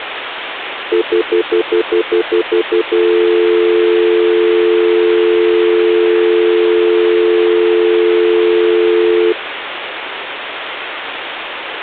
Telephone call progress tone (North American plan), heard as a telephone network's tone, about 350, 440 Hz, 0.1 s on and 0.1 s off, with phone line noise. Stutter dial tone.